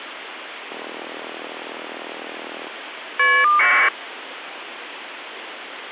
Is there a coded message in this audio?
Yes: caller ID data burst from 0.7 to 3.9 s, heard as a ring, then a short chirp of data, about 1200 baud, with phone line noise.